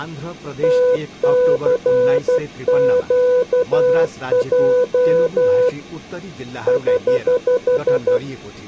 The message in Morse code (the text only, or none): TCQJ <HH>